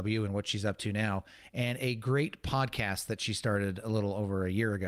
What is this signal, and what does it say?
Speech in English. There is no code.